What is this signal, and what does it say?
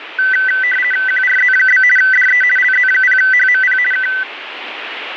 RTTY (50 baud, 450 Hz shift), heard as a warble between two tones, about 1750 Hz centre, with radio static. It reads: QRZ? DE LZ0HMP K